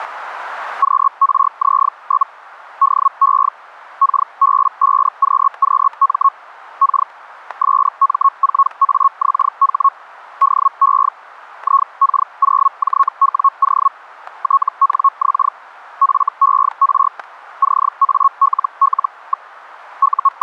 Hellschreiber (Feld-Hell, 122.5 baud), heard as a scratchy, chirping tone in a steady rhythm, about 1100 Hz, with static crashes. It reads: QRZ? DE KB5QQM K SM4AXH DE IK0JWO TNX FER CALL. …